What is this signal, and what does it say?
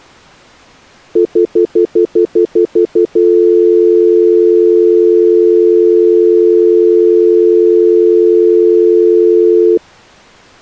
Telephone call progress tone (North American plan), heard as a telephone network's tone, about 350, 440 Hz, 0.1 s on and 0.1 s off. Stutter dial tone.